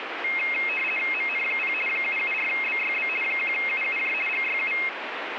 RTTY (50 baud, 450 Hz shift), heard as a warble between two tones, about 2350 Hz centre, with radio static. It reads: MN0 774BYB 1UUJ GYU